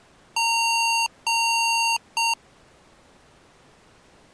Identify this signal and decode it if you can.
Beep code, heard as beeps from a small speaker, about 920 Hz. 2 long, 1 short.